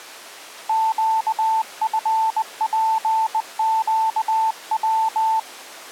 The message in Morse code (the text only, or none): QFPQW